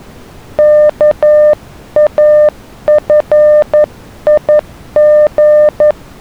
Morse code, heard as a keyed tone, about 11 wpm, 600 Hz. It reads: KAFIG